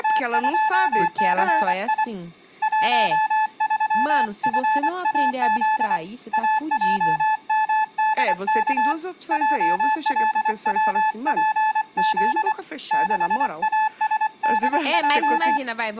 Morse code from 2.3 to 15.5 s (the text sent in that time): 13FAZ AJMDK JLWPZ 6ASDJ